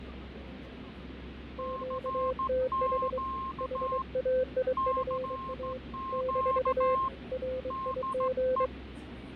Morse code, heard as two keyed tones, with fading and the noise inside a subway train. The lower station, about 23 wpm, 510 Hz: QTH HAIFA - RIG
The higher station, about 16 wpm, 1060 Hz: CQ CQ DE